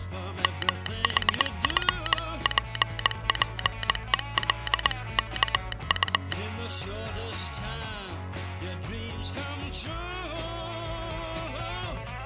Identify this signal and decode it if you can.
Morse code (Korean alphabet), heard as a telegraph sounder, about 20 wpm. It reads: 문짝이